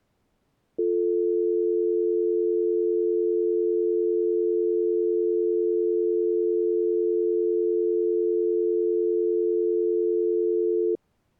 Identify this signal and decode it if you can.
Telephone call progress tone (North American or UK plan), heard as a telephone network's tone, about 350, 440 Hz. Dial tone.